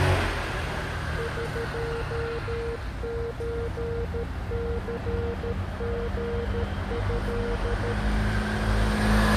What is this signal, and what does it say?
Morse code (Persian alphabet), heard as a keyed tone, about 13 wpm, 470 Hz, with street noise. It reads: قچثژض